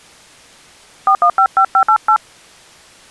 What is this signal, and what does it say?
DTMF, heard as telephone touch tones, dialled by hand, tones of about 80 ms. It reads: 4155588